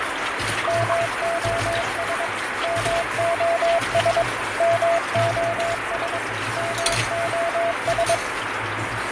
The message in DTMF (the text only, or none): none